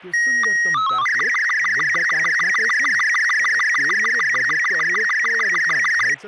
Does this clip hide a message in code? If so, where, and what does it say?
Yes: SSTV (slow-scan television), Robot 36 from 0.1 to 6.1 s, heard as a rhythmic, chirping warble, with speech in Nepali.